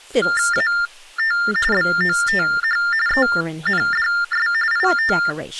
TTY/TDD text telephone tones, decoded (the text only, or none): AT BOTH ENDS IT